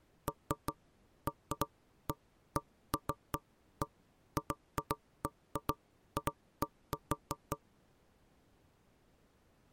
Irregular knocks on wood. There is no code.